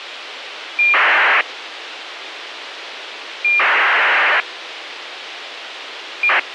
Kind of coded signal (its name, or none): ACARS aircraft data